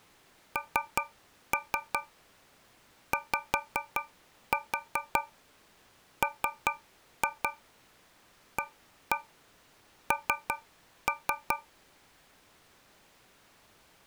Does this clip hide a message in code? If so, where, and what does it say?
Yes: tap code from 0.6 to 11.7 s, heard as taps on a metal pipe, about 5 knocks a second. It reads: NYMAN